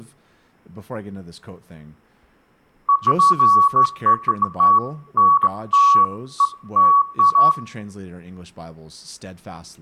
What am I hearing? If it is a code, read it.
Beeps of irregular length, with room echo and speech in English. There is no code.